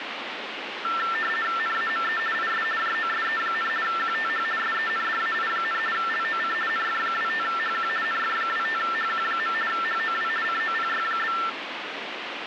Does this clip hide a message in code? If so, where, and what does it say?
Yes: RTTY (50 baud, 450 Hz shift) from 0.8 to 11.5 s, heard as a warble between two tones, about 1550 Hz centre, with radio static. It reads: NAME IS JOSE, QTH SENDAI, LOC NF25HQ NF25HQ. HOW COPY?